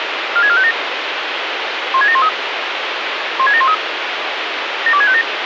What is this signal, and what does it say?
Five-tone selective call (ZVEI), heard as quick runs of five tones, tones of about 70 ms, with radio hiss. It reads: 46457 16713 16713 72657